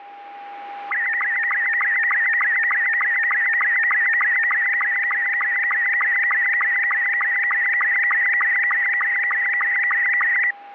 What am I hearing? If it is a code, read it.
SSTV (slow-scan television), Robot 72, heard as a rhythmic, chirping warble, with a steady whistle near 810 Hz.